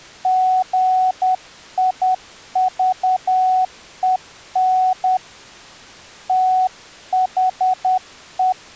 Morse code, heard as a keyed tone, hand-sent with a paddle, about 10 wpm, 740 Hz. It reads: GIVEN THE